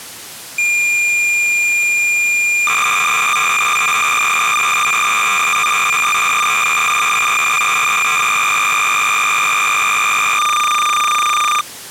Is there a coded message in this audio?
Yes: cassette data (Kansas City type), 300 baud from 0.6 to 11.6 s, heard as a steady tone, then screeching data.